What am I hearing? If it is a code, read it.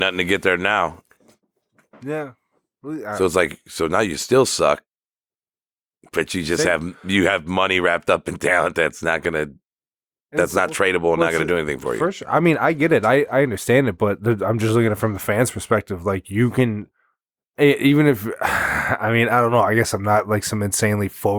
Speech in English. There is no code.